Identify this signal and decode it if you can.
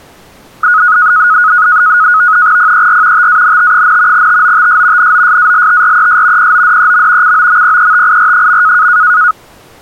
NAVTEX (SITOR-B), 100 baud, 170 Hz shift, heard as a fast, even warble, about 1360 Hz centre. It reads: PER TANT, TOTS NOSALTRES PODEM COMPETIR.